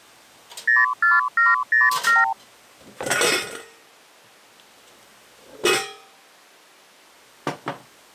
Multi-frequency trunk signalling (R2, with the far end's replies), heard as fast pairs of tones, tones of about 170 ms, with kitchen noise. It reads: 04707